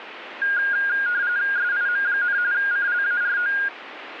RTTY (45.45 baud, 170 Hz shift), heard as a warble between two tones, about 1550 Hz centre, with radio static. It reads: SIM, CLARO